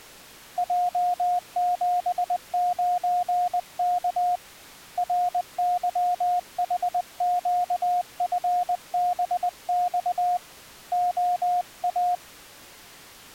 Morse code, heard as a keyed tone, hand-sent with a paddle, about 20 wpm, 720 Hz. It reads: J79K RYHQFBX OA